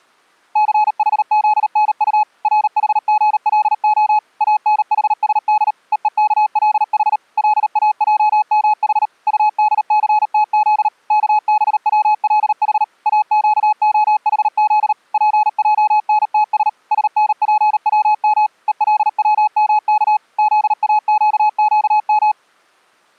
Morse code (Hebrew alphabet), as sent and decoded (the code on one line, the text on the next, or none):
-.-. .... --.. -. ..- / .-. .... --. .-.. --- / .- -. .... ... -.. / . . -.- .-.. .... / .-.. .- .--- -- .... / ..- -.. -.-. - --.. / -.- -... .-- .-.. .... / .- --.- --- .... --.. / .--. .--- -. - ... / ... -. .--. .-- -- / . .-.. .-- -- -.- / --.. .- --.- --.- --
סחזנט רחגלה אנחשד ווכלח לאעמח טדסתז כבצלח אקהחז פענתש שנפצם ולצמך זאקקם